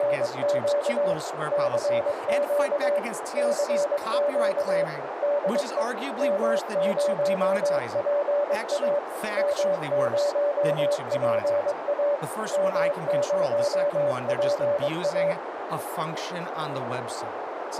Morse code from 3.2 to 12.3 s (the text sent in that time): CQ DE M0PA M0PA